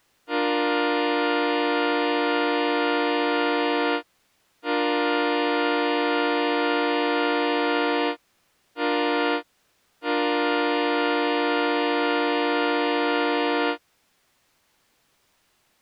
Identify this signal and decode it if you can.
Train horn signal, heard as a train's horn. 2 long, 1 short, 1 long. On North American railways: approaching a public crossing.